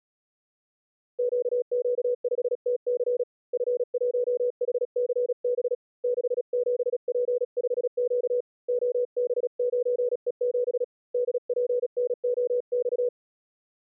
Morse code, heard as a keyed tone, hand-sent with a paddle, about 36 wpm, 490 Hz. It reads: QQ5TC F1HCB 67P5Q OB9E7 DPNOX